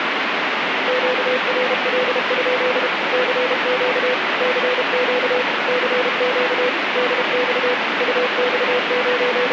Morse code, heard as a keyed tone, machine-sent, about 32 wpm, 500 Hz, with heavy radio static. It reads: QRL? CQ CQ CQ DX …